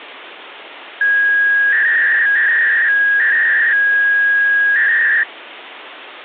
300-baud modem data (V.21 tones), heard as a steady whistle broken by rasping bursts, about 300 baud, 200 Hz shift, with phone line noise.